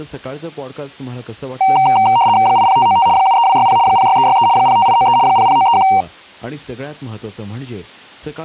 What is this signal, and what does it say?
RTTY (75 baud, 170 Hz shift), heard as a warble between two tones, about 850 Hz centre, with speech in Gujarati. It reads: 80595 73260 06363 05893 00931